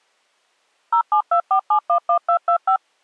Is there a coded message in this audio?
Yes: DTMF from 0.9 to 2.8 s, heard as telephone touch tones, dialled by machine, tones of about 90 ms. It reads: 0724711225